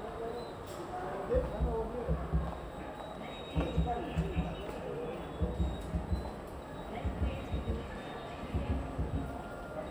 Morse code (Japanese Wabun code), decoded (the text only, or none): none